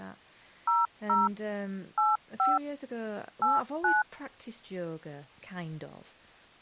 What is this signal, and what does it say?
DTMF, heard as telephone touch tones, dialled by machine, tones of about 180 ms, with speech in English. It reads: 00 85 89